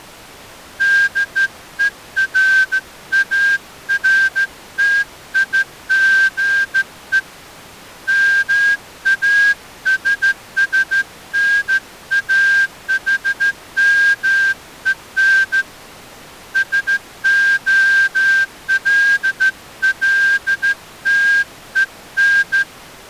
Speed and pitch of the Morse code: 14 wpm

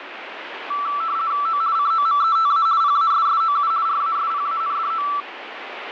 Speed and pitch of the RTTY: 50 baud, 170 Hz shift, 1240 Hz centre

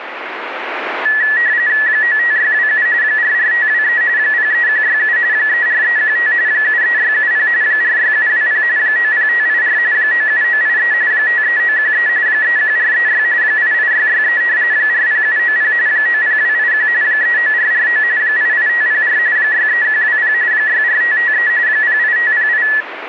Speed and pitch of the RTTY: 45.45 baud, 170 Hz shift, 1800 Hz centre

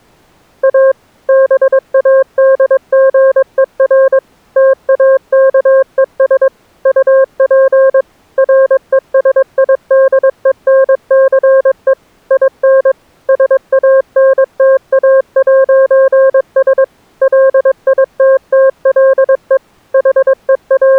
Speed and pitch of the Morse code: 22 wpm, 530 Hz

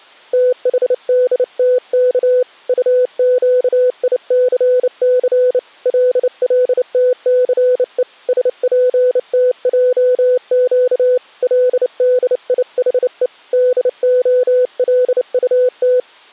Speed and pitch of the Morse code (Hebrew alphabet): 29 wpm, 500 Hz

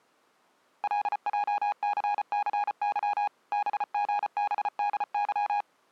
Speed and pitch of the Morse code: 34 wpm, 820 Hz

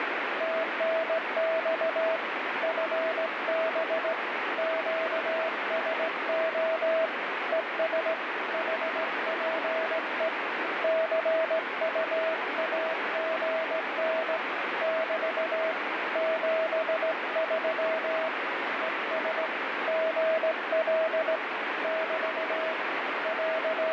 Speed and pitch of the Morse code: 17 wpm, 650 Hz

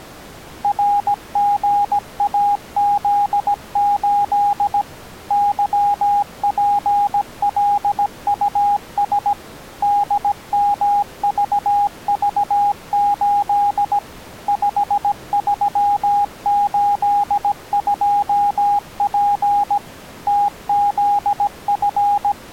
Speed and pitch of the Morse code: 17 wpm, 820 Hz

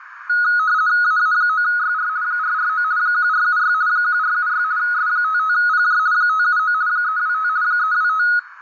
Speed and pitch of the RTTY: 50 baud, 170 Hz shift, 1360 Hz centre

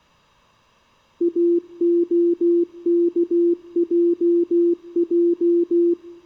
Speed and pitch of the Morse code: 16 wpm, 340 Hz

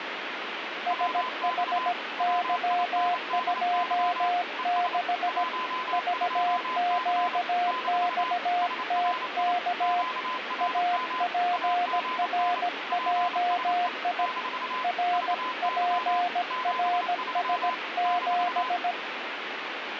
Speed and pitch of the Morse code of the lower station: 17 wpm, 710 Hz

